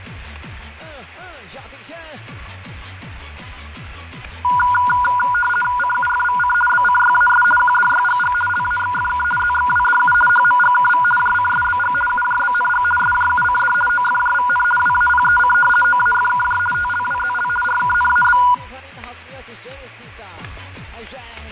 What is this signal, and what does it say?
RTTY (50 baud, 450 Hz shift), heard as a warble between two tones, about 1210 Hz centre, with fading and static crashes. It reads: CUFVC BCYAS QDYGG LAXFK ZXWDU HMGKV JCSBG UJBNG SJUCD OFJVN WAPEC OAFKJ TLWZL RKNAB